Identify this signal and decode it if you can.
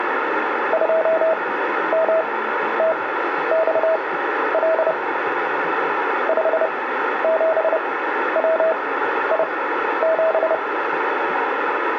Morse code, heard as a keyed tone, machine-sent, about 30 wpm, spaced as for 12 wpm, 650 Hz, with radio static and room echo. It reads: 2MTXL 57WI7